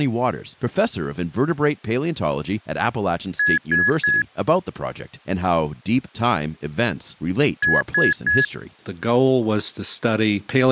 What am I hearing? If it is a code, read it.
Beep code, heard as beeps, played twice, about 1700 Hz, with speech in English. 3 short. In AMI BIOS tables: failure in the first 64 KB of memory; in Dell tables: chipset error.